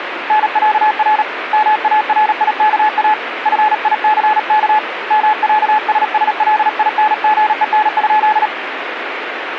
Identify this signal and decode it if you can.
Morse code (with Swedish letters), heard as a keyed tone, hand-sent with a paddle, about 37 wpm, 860 Hz, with radio static. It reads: NÄR MARIKA FICK MÄSSLINGEN?